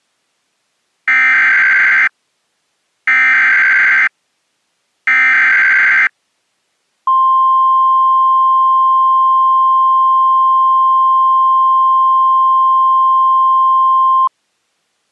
Emergency Alert System (SAME) tones (header bursts, then the 1050 Hz attention tone), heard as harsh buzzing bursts, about 520.83 baud.